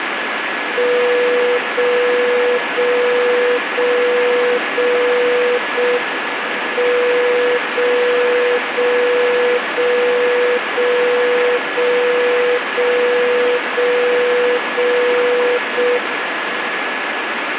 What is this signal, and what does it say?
Radio time signal (JJY), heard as a tone whose level steps once a second, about 490 Hz, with radio static and a steady whistle near 1700 Hz. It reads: 0 0 0 0 0 M 0 0 0 0 0 0 0 0 0 M